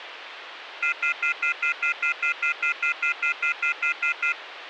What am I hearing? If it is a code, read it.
Telephone call progress tone (North American plan), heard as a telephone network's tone, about 1400, 2050, 2450, 2600 Hz, 0.1 s on and 0.1 s off, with phone line noise. Off-hook warning tone.